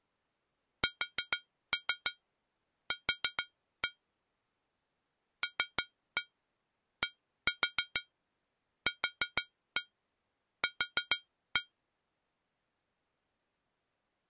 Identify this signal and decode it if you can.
Tap code, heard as taps on a metal pipe, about 6 knocks a second. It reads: SQ LDQQ